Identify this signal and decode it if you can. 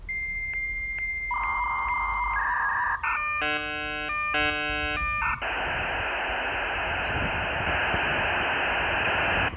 Dial-up modem handshake (V.34 or later), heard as a whistle, warbles, then hiss, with room echo and the noise of a residential street.